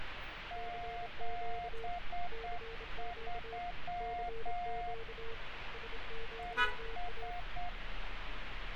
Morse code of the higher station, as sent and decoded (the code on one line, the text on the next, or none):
--... ...-- / . ...
73 ES